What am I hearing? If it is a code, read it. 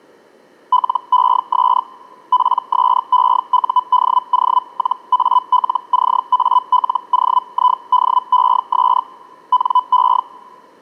Hellschreiber (Feld-Hell, 122.5 baud), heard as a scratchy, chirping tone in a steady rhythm, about 1000 Hz. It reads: LES PSEUDO-ALCALOIDES NE